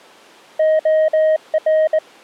Morse code, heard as a keyed tone, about 21 wpm, 630 Hz. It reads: OR